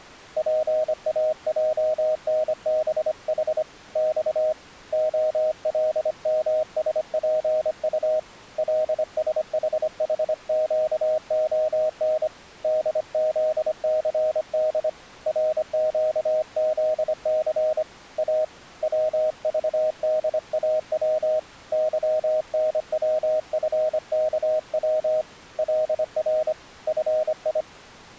Morse code, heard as a keyed tone, hand-sent with a paddle, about 25 wpm, 620 Hz. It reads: PAJNBH X OLMSPU LSHHQON DZCD RQZC A WVDAW YNWFKW LR FI